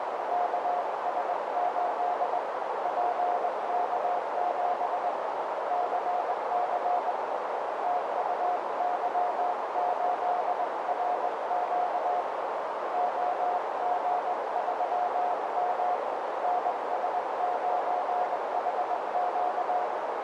Morse code, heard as a keyed tone, hand-sent with a straight key, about 20 wpm, 720 Hz, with heavy radio static and a narrow filter. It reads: KS8 PK7 CC TUY8RQ OG3M NS9HQ